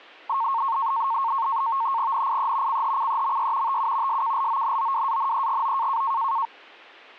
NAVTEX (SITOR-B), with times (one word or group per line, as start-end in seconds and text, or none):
2.1-2.8 NIE
2.7-3.8 CHCEMY
3.7-4.2 TU
4.1-6.0 SKLONOWANEGO